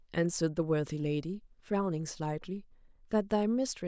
Speech in English. There is no code.